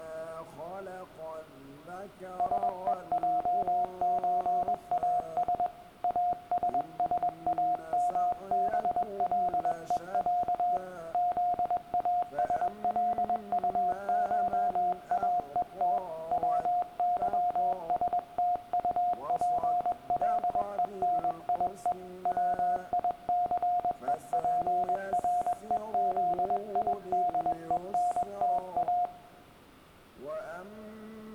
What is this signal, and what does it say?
Morse code (Russian alphabet), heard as a keyed tone, hand-sent with a paddle, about 21 wpm, 710 Hz, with room echo. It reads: СЕЙЧАС АССАМБЛЕЯ ЗАСЛУШАЕТ ВЫСТУПЛЕНИЕ ВИЦЕПРЕЗИДЕНТА